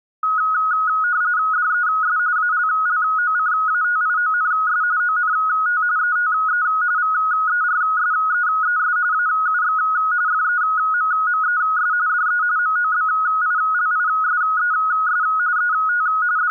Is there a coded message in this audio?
Yes: RTTY (45.45 baud, 170 Hz shift) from 0.2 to 16.5 s, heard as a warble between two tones, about 1360 Hz centre. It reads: DES ALLOCATIONS ONT ETE VERSEES AUX FEMMES DE MOBILISES ET …